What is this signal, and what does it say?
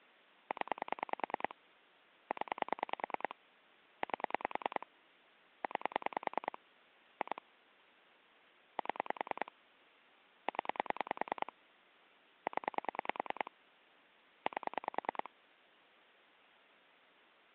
Pulse dialling, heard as clicks on a phone line, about 10 pulses a second. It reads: 0 0 8 9 2 7 0 0 8